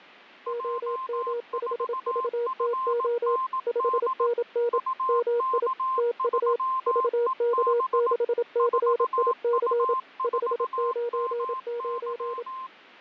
Morse code, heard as two keyed tones, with radio static and fading. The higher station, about 18 wpm, 1050 Hz: J4FND UK3EB 4U4MY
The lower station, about 27 wpm, 480 Hz: OM5VTO 5NN MI TU VK6CIC 599